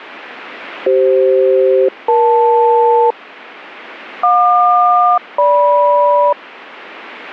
Aircraft SELCAL, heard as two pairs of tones. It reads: CF-EL JQ-GM